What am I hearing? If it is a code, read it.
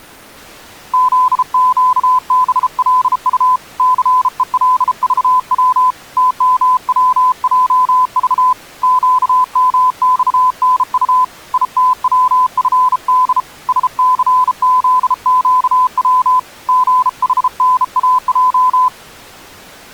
Morse code, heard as a keyed tone, hand-sent with a bug key, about 33 wpm, 1010 Hz. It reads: ZQBLU CELVW TMWJV QMXNU ITWFD SCZQW GHNAJ